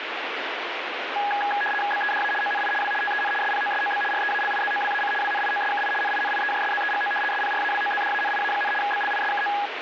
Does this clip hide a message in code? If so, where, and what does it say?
Yes: RTTY (75 baud, 850 Hz shift) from 1.2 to 9.7 s, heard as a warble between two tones, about 1240 Hz centre, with radio static. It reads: BEDA ONI W TEN SPOSOB REALIZOWAC WNIOSKI NINIEJSZEGO SPRAWOZDANIA, BLISKO